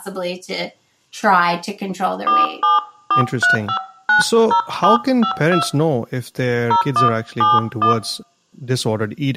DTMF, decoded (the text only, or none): 4743590752 0171